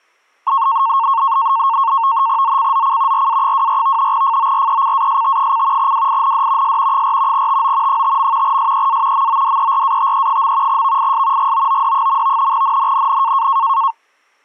NAVTEX (SITOR-B), 100 baud, 170 Hz shift, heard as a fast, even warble, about 1000 Hz centre. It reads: ZCZC RA24 FORECAST: WIND S 4 TO 5. SEA MODERATE. VIS GOOD. NNNN